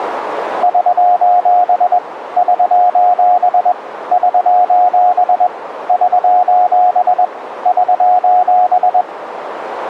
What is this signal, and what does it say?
Morse code, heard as a keyed tone, hand-sent with a paddle, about 21 wpm, 720 Hz, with radio static. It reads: <SOS> <SOS> <SOS> <SOS> <SOS>